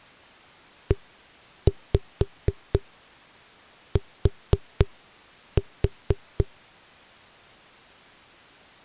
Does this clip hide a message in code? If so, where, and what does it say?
Yes: tap code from 0.9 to 6.5 s, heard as knocks on a wall, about 4 knocks a second. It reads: ET